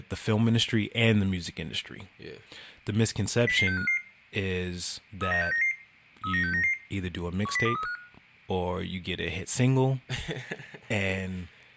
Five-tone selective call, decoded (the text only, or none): 00655 39699 39699 10235